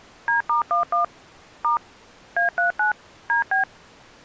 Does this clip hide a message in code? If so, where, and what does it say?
Yes: DTMF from 0.3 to 3.6 s, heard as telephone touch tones, dialled by machine, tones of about 120 ms. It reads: D*11 * A39 DB